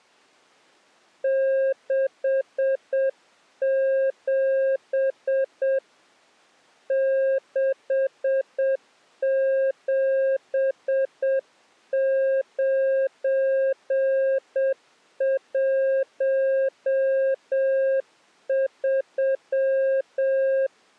Morse code, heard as a keyed tone, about 7 wpm, 540 Hz. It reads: 67 67913